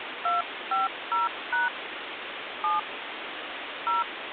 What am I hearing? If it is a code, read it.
DTMF, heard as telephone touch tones, dialled by hand, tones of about 160 ms, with phone line noise. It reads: 250# 7 0